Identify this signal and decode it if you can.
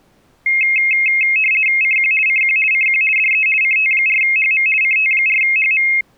RTTY (50 baud, 450 Hz shift), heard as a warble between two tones, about 2350 Hz centre. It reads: CQ CQ CQ DE CT4HM CT4HM